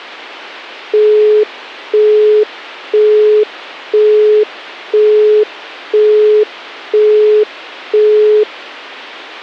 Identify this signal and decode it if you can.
Telephone call progress tone (single-tone plan, as in Europe, Japan and elsewhere), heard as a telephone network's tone, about 420 Hz, 0.5 s on and 0.5 s off. Busy tone.